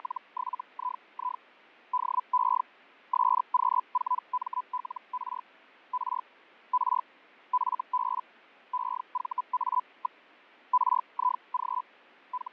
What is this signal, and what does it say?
Hellschreiber (Feld-Hell, 122.5 baud), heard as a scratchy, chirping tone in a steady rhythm, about 1000 Hz, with fading. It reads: … DE SQ4MLR R R FB EVA. RIG …